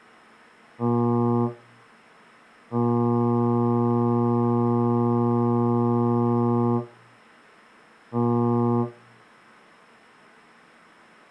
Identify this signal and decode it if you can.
Ship horn signal, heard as a ship's horn, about 120 Hz. 1 short, 1 long, 1 short. At sea: a vessel at anchor warns of its position.